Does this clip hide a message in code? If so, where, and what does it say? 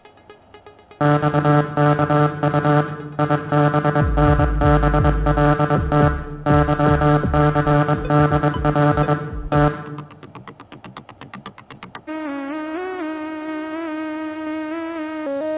Yes: Morse code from 0.9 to 9.7 s, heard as a buzzer, machine-sent, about 22 wpm, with room echo. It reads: XKU IBNBLT YCDL T